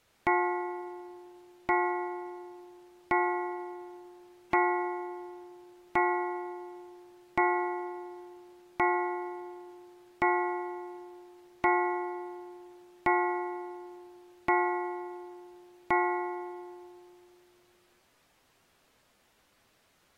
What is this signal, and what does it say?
Clock strike, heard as a bell. 12. Twelve o'clock.